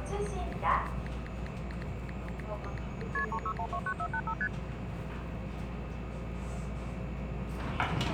Multi-frequency trunk signalling (R1, as on North American trunks), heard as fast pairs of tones, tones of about 70 ms, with hum and the noise inside a subway train. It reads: KP 36129485 ST